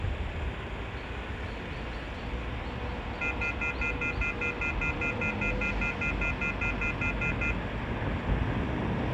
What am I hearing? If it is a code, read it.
Telephone call progress tone (North American plan), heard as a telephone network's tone, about 1400, 2050, 2450, 2600 Hz, 0.1 s on and 0.1 s off, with phone line noise, room echo and street noise. Off-hook warning tone.